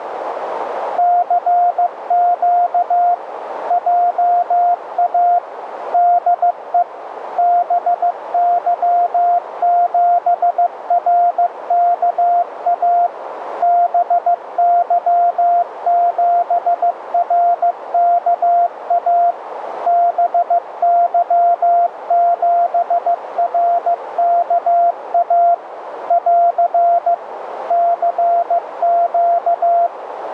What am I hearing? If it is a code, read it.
Morse code, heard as a keyed tone, machine-sent, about 15 wpm, 700 Hz, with radio static and a narrow filter. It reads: CQ JA DE BY7RKA BY7RKA BY7RKA <AR> CQ